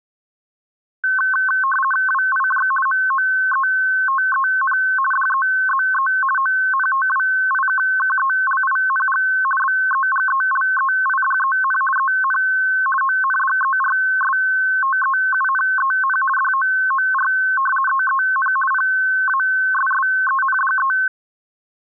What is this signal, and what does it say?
RTTY (50 baud, 450 Hz shift), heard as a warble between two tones, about 1300 Hz centre. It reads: WIJ MOETEN DEZE ONTWIKKELING BEGELEIDEN EN ONDERSTEUNEN DOOR EEN PASSENDE